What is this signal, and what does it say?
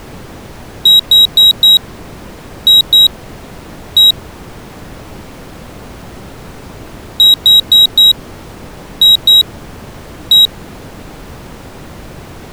Beep code, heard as a piezo beeper, played twice, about 3850 Hz. 4-2-1. In Phoenix BIOS tables: timer tick failure.